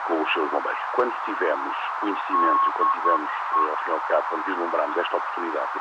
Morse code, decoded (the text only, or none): DE